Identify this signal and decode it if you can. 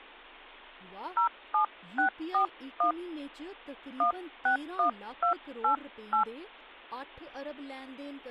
DTMF, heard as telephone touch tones, dialled by hand, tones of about 110 ms, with speech in Dogri. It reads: 07641 161288